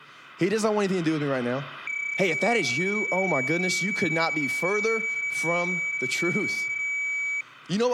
PSK31 (31.25 baud), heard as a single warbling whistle, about 2300 Hz, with speech in English.